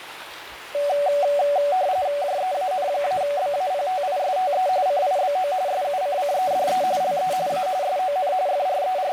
RTTY (45.45 baud, 170 Hz shift), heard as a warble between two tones, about 660 Hz centre, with radio static and the noise of a restroom. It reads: JEAN-BAPTISTE CIBO SUCCEDE LE A SON …